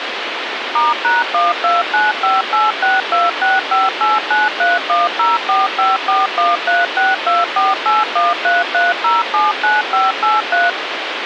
DTMF, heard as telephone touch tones, dialled by machine, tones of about 180 ms, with phone line noise. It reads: *#12958626589310454136248133079583